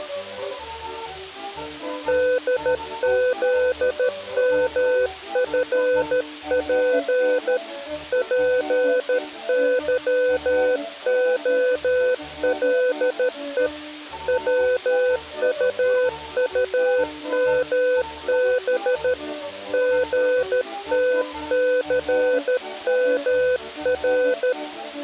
Morse code, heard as a keyed tone, hand-sent with a paddle, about 13 wpm, 500 Hz. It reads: DZMFP PYOLE WUUMB GTCMR